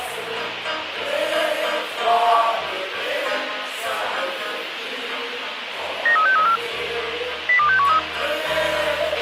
Five-tone selective call (CCIR), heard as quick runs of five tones, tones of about 100 ms, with radio hiss and a squelch burst at the end. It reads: 93634 02613